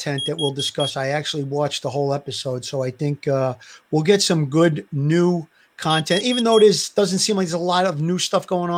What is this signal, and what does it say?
Alarm pattern, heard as an alarm's beeps, played twice, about 3300 Hz, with speech in English. Temporal four. Carbon monoxide.